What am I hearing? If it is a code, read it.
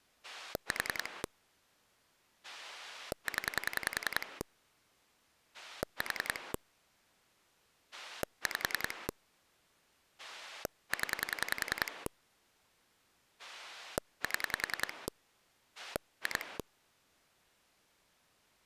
Pulse dialling, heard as a rotary dial, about 10 pulses a second. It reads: 4 0 4 5 0 7 2